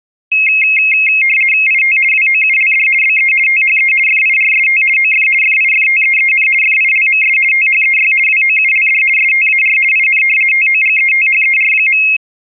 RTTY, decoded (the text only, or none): IT WOULD BE THE FIRST OF FIFTEEN FILMS THEY WOULD STAR IN TOGETHER.